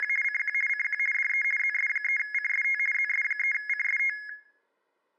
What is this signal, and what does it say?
RTTY (50 baud, 450 Hz shift), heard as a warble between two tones, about 1900 Hz centre. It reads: … CQ CQ DE ZS3CST ZS3CST